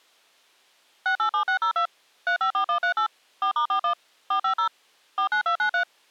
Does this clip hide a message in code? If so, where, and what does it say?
Yes: DTMF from 1.1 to 5.8 s, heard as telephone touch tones, dialled by machine, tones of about 100 ms. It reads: 687602 354138 4*41 450 49293